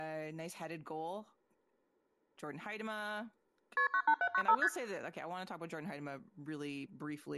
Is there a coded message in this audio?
Yes: multi-frequency trunk signalling (R1, as on North American trunks) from 3.8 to 4.7 s, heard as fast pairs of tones, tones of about 70 ms, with speech in English. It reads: KP 98795 ST